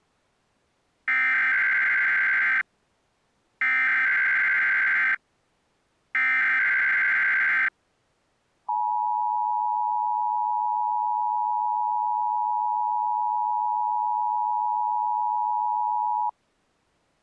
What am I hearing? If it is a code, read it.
Emergency Alert System (SAME) tones (header bursts, then the 853 and 960 Hz attention tone), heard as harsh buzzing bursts, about 520.83 baud.